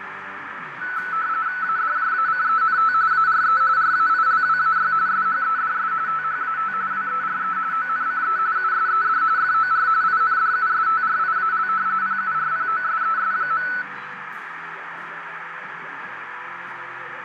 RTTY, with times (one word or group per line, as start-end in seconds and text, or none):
1.6-2.9 ADJACENT
3.1-3.6 ARE
3.8-4.9 RAILWAY
5.1-5.9 SHEDS
6.1-6.7 THAT
6.9-7.6 WERE
7.7-8.4 ONCE
8.6-9.2 USED
9.4-9.9 FOR
10.0-11.7 INDUSTRIAL
12.0-13.7 PURPOSES.